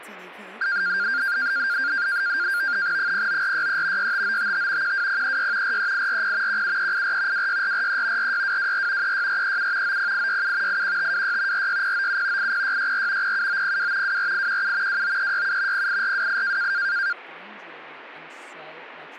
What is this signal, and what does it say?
NAVTEX (SITOR-B), 100 baud, 170 Hz shift, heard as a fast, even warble, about 1500 Hz centre, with speech in English. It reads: 09463 65955 12036 43840 17384 26443 46224 36437 90867 81526 46097 80664 07902 24817 29367 08428